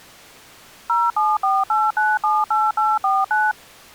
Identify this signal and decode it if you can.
DTMF, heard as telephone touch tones, dialled by machine, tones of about 210 ms. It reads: 0748978849